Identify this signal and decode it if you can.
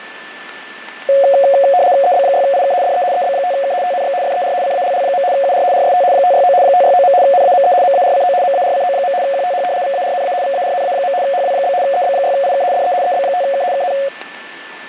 RTTY (75 baud, 170 Hz shift), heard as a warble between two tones, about 640 Hz centre, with radio static and a steady whistle near 1760 Hz. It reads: EB6IK DE EB5K TNX FER CALL. UR RST 569 569. NAME MARCO MARCO. QTH VARNA VARNA. HW? EB6IK DE EB5K KN